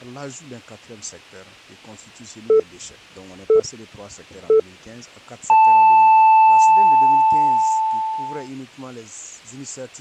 Radio time signal (three low pips and a long one an octave up, as on NHK), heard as pips.